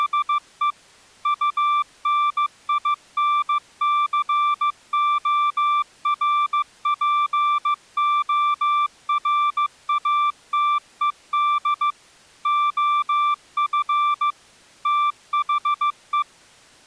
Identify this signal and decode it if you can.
Morse code, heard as a keyed tone, machine-sent, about 15 wpm, 1180 Hz. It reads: … UNINCORPORATED OF THE